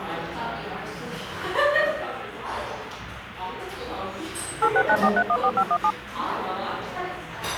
DTMF, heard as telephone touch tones, dialled by machine, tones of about 60 ms, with the noise of a cafe. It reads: 8694314517